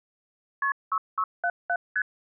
Multi-frequency trunk signalling (R1, as on North American trunks), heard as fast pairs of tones, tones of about 60 ms. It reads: KP 6677 ST